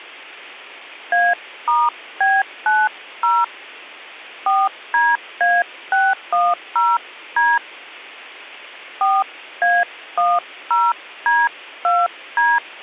DTMF, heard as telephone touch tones, dialled by hand, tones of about 210 ms. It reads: A*B90 4DA610D 4A10D2D